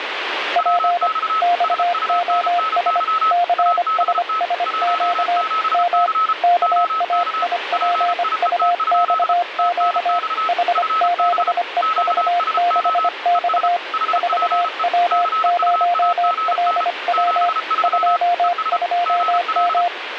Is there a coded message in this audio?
Yes: Morse code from 0.5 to 19.9 s, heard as two keyed tones, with radio static. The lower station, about 25 wpm, 700 Hz: P XOS CSSQ M KAIPUXQ H7EV6X 4W0LW 22M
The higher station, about 33 wpm, 1290 Hz: WX SUNNY ABT 17C OK PIET? TNX FB QSO ES HPE CUAGN 73 ES GL